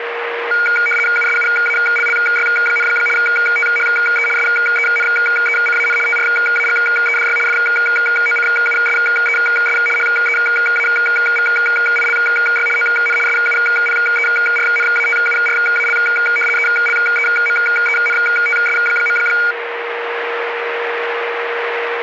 RTTY (75 baud, 850 Hz shift), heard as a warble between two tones, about 1850 Hz centre, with radio static and a steady whistle near 470 Hz. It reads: USUALLY, THE SENECAN TRAGEDY FOCUSES HEAVILY ON SUPERNATURAL ELEMENTS.